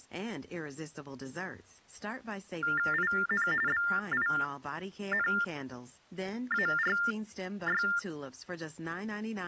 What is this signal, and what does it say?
TTY/TDD text telephone tones (45.45 baud Baudot), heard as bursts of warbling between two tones, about 400 Hz shift, 1600 Hz centre, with speech in English. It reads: IN BINARY